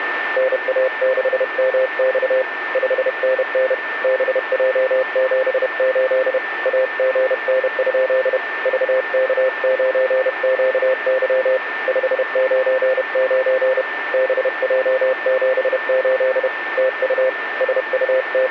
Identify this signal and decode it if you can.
Morse code, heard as a keyed tone, hand-sent with a paddle, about 31 wpm, 520 Hz, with radio static and a steady whistle near 1790 Hz. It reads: NA6MX 5NN BJ78 AGN? VK9QY 599 BJ78 TU …